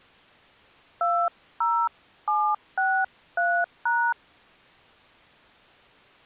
DTMF, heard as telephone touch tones, dialled by hand, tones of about 270 ms. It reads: 20763#